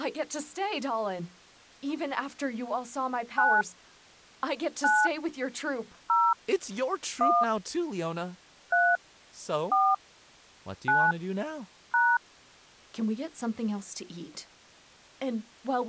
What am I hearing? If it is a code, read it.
DTMF, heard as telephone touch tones, dialled by hand, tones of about 230 ms, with speech in English. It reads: 9 9 0 1 3 4 9 #